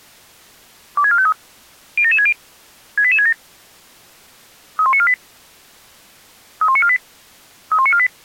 Five-tone selective call (ZVEI), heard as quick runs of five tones, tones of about 70 ms. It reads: 26453 07760 68867 31948 31948 31948